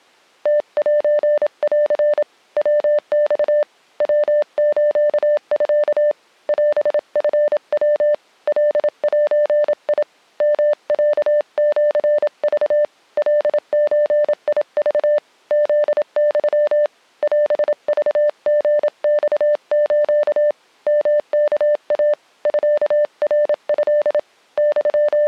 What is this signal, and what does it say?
Morse code (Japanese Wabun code), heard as a keyed tone, hand-sent with a paddle, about 27 wpm, 590 Hz. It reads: ムセン ヤマ ヤスミ オチヤ カゼ ヨロシク カゾク フユ オクリマス ヨワイ ミナト …